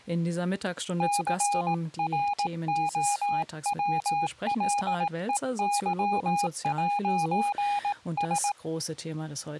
Morse code, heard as a keyed tone, hand-sent with a paddle, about 18 wpm, 820 Hz, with speech in German. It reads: CROWLEY'S